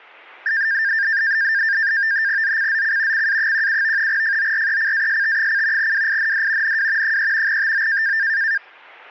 NAVTEX (SITOR-B), 100 baud, 170 Hz shift, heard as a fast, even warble, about 1700 Hz centre. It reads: ZCZC CA17 FORECAST: WIND NW 3 TO